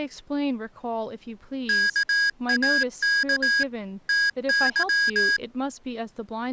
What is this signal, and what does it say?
Morse code (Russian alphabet), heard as electronic beeps, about 18 wpm, 1650 Hz, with speech in English. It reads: КАК ТЫ